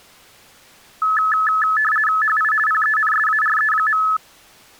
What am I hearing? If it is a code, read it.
RTTY (50 baud, 450 Hz shift), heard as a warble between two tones, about 1500 Hz centre. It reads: HI PENSARE.